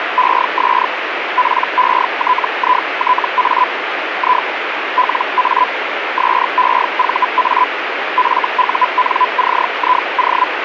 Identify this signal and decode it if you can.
Hellschreiber (Feld-Hell, 122.5 baud), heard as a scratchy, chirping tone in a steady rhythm, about 1000 Hz, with radio static. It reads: ES PETITA I LA SEVA FUNCIO